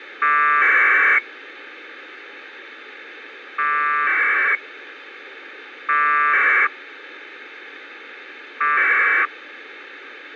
Packet radio (AX.25, as in APRS), 1200 baud, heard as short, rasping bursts, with radio hiss.